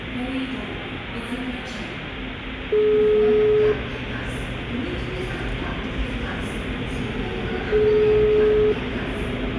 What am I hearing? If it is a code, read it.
Telephone call progress tone (single-tone plan, as in most of Europe), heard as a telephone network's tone, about 420 Hz, 1 s on and 4 s off, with room echo and the noise of a subway station. Ringback tone.